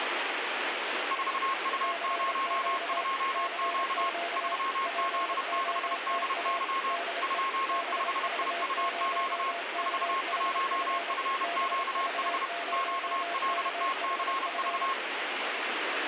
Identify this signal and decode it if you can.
Morse code, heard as two keyed tones, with radio static. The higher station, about 31 wpm, 1080 Hz: 4U02Q 3Z6DY 25IUQ 41FQH QLTCV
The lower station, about 27 wpm, 690 Hz: CQ CQ POTA DE BV0KHF BV0KHF